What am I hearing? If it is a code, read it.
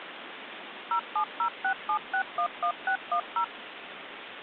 DTMF, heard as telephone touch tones, dialled by machine, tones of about 90 ms, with phone line noise. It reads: 07067611610